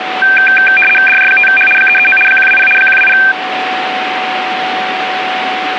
RTTY (75 baud, 850 Hz shift), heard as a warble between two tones, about 2000 Hz centre, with radio static and a steady whistle near 750 Hz. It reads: DJ5H 339 120 120